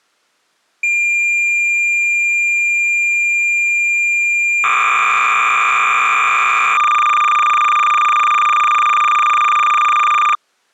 Cassette data (Kansas City type), 300 baud, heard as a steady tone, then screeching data.